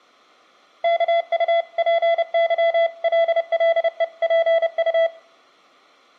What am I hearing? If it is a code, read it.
Morse code (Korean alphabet), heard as a keyed tone, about 30 wpm, 670 Hz, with room echo. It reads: 이제까지